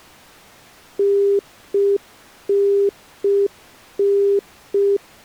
Telephone call progress tone (UK plan), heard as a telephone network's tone, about 400 Hz. Congestion tone.